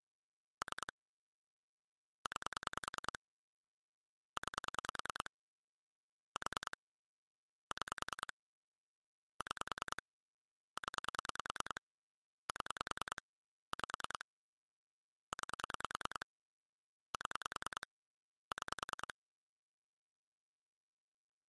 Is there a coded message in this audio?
Yes: pulse dialling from 0.6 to 19.1 s, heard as clicks on a phone line, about 10 pulses a second. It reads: 3 9 9 4 6 6 0 7 5 9 7 6